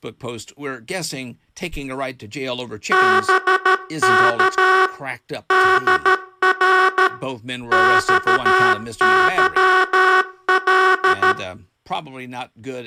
Morse code, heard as a buzzer, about 13 wpm, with room echo and speech in English. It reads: BK DR XYL